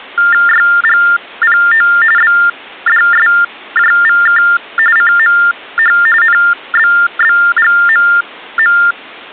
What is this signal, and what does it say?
TTY/TDD text telephone tones (45.45 baud Baudot), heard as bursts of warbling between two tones, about 400 Hz shift, 1600 Hz centre. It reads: YGPO BDSJVK CMH NBBGMM